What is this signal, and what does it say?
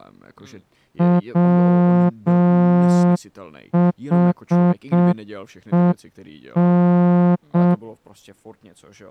Morse code, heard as a horn, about 6 wpm, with speech in Czech. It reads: WHEN